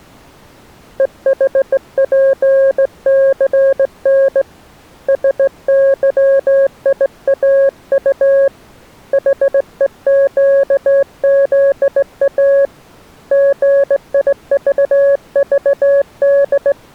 Morse code, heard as a keyed tone, hand-sent with a straight key, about 17 wpm, 550 Hz. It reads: EHPCN SYIAU HEQZA GIVVD